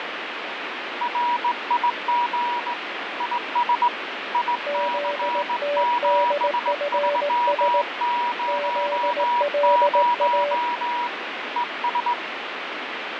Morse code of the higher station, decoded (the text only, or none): RIG IS IC7300 ES